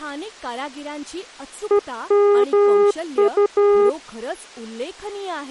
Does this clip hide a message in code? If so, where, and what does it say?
Yes: Morse code (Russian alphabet) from 1.6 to 4.0 s, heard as a keyed tone, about 13 wpm, 410 Hz, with speech in Marathi. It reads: ЕМУ